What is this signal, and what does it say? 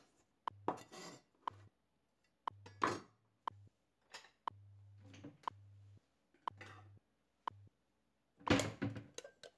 Radio time signal (WWV, Colorado), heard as ticks, one a second, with kitchen noise.